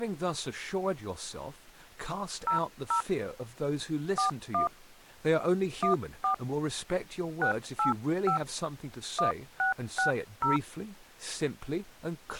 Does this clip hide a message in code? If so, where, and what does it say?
Yes: DTMF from 2.5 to 10.6 s, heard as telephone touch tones, dialled by hand, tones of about 120 ms, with speech in English. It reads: 00 41 14 685 1660